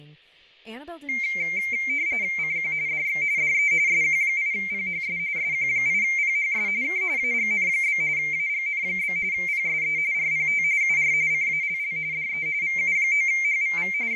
RTTY (45.45 baud, 170 Hz shift), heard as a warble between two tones, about 2200 Hz centre, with fading and speech in English. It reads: CQ DX DE SQ8PHS SQ8PHS K AGN? AGN? PSE RPT UR CALL DE VU9HVV …